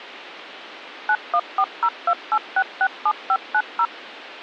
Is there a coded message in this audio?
Yes: DTMF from 1.1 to 3.9 s, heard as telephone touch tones, dialled by machine, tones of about 60 ms. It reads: 914028667590